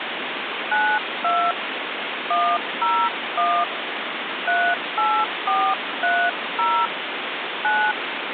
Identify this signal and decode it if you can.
DTMF, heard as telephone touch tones, dialled by hand, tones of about 270 ms, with phone line noise. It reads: 92 101 38430 9